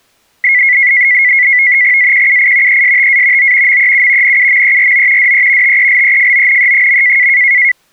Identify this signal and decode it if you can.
NAVTEX (SITOR-B), 100 baud, 170 Hz shift, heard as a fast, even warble, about 2050 Hz centre. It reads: AQUI ESTA O MEU NUMERO DE TELEFONE.